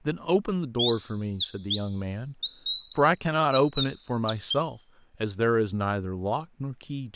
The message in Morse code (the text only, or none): none